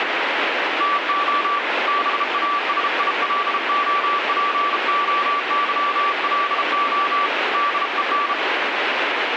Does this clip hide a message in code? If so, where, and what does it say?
Yes: Morse code (Greek alphabet) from 0.7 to 8.4 s, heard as a keyed tone, hand-sent with a bug key, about 33 wpm, 1160 Hz, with radio static. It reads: ΤΟ ΒΑΣΙΛΟΠΟΥΛΟ ΔΕΝ